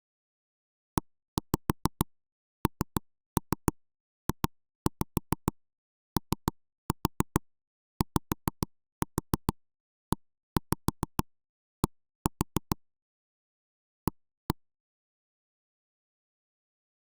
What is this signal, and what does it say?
Tap code, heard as knocks on wood, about 6 knocks a second. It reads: ENJOYED A